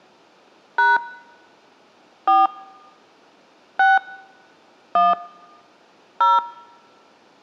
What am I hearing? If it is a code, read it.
DTMF, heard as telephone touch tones, dialled by hand, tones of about 180 ms. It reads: # 4 6 1 0